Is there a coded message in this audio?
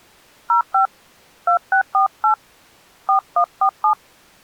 Yes: DTMF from 0.5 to 3.9 s, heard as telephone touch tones, dialled by hand, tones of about 100 ms. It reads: 05 2648 4147